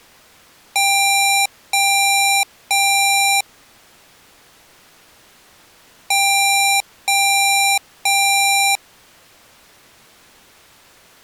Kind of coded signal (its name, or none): beep code